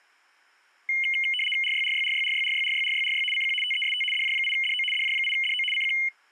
RTTY (75 baud, 850 Hz shift), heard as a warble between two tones, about 2550 Hz centre. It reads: RYRYRYRYRYRYRYRY CQ TEST DJ8DO DJ8DO CQ